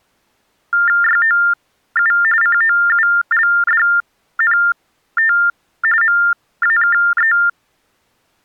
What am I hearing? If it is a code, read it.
TTY/TDD text telephone tones (45.45 baud Baudot), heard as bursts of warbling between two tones, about 400 Hz shift, 1600 Hz centre. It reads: YOU COULDNT MAKE